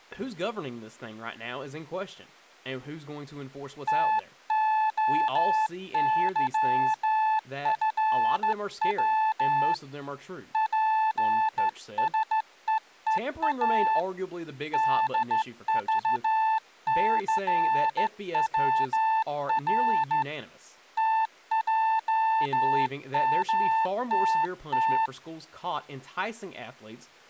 Morse code, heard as a keyed tone, hand-sent with a straight key, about 14 wpm, 880 Hz, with speech in English. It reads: TOYFW PSEEA DVCWR TJMTT